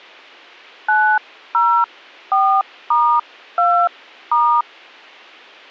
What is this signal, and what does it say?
DTMF, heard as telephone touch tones, dialled by hand, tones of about 300 ms. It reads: 904*2*